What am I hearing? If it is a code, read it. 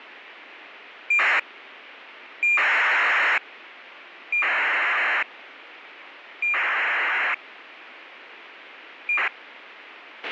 ACARS aircraft data, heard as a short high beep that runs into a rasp, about 2400 baud, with radio hiss and a squelch burst at the end.